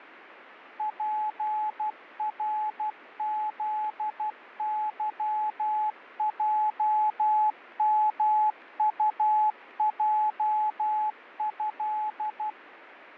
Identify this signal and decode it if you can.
Morse code (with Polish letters), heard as a keyed tone, machine-sent, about 12 wpm, 860 Hz, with radio static. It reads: PRZYJMUJĘ